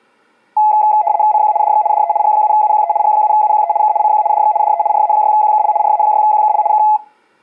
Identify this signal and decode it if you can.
RTTY (75 baud, 170 Hz shift), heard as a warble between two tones, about 770 Hz centre. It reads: CQ DX DE G7UQE G7UQE K CQ DX DE RA6QKL RA6QKL K